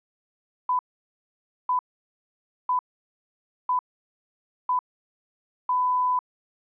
Radio time signal (six pips, as the Greenwich Time Signal), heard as pips.